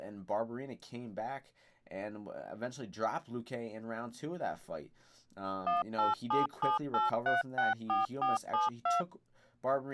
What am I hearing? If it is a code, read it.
DTMF, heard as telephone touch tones, dialled by machine, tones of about 160 ms, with speech in English. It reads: 18778364472